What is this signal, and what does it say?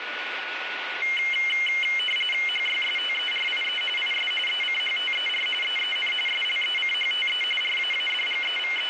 RTTY (45.45 baud, 850 Hz shift), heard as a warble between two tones, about 2550 Hz centre, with radio static and a steady whistle near 1460 Hz. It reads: HYSTERIE IS ECHTER EEN SLECHTE …